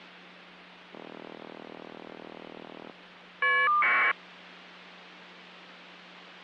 Caller ID data burst, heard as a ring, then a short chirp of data, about 1200 baud, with hum.